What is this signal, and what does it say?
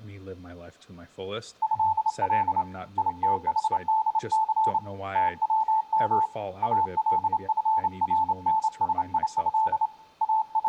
Morse code (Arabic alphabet), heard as a keyed tone, hand-sent with a straight key, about 28 wpm, 880 Hz, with room echo and speech in English. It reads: هل يتحدث توم الفرنسيه …